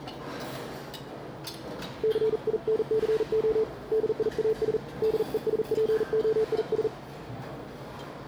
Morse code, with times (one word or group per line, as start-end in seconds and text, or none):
2.0-3.6 CINCO
3.9-4.8 DIAS
5.0-6.9 DESPOIS